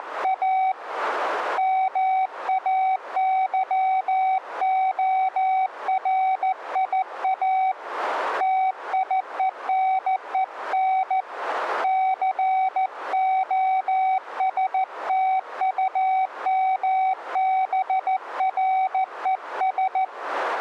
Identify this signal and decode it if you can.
Morse code, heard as a keyed tone, hand-sent with a paddle, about 14 wpm, 760 Hz. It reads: … MAYORIA TIENEN COSTUMBRES